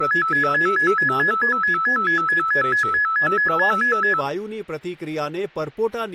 A tone that alternates evenly between two pitches, with speech in Gujarati. There is no code.